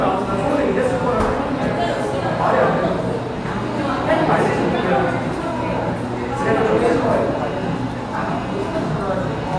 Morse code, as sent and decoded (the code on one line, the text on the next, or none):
none